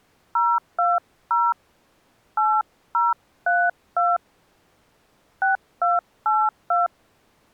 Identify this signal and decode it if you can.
DTMF, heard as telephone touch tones, dialled by hand, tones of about 180 ms. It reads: 020 8032 6282